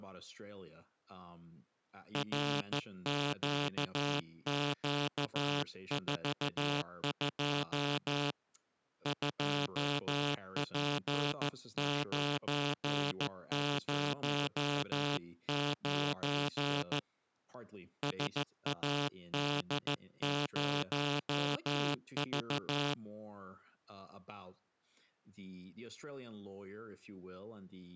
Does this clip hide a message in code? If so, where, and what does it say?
Yes: Morse code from 2.1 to 23.0 s, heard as a buzzer, hand-sent with a straight key, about 14 wpm, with speech in English. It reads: RQQ42 2P909 SAD0V